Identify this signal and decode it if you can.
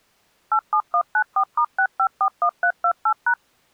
DTMF, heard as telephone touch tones, dialled by machine, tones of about 80 ms. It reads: 87194*6541328#